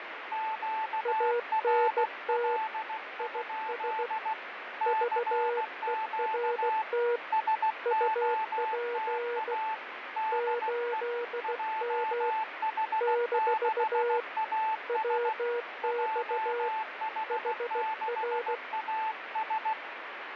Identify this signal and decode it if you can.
Morse code, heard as two keyed tones, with radio static and fading. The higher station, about 16 wpm, 880 Hz: QRL? CQ SOTA DE JH6AS JH6AS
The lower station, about 16 wpm, 480 Hz: ANT IS VERT UP 8M - WX HR